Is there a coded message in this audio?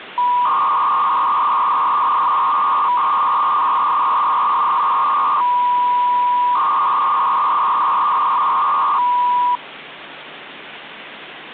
Yes: 300-baud modem data (V.21 tones) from 0.2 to 9.6 s, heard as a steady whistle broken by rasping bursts, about 300 baud, 200 Hz shift, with phone line noise.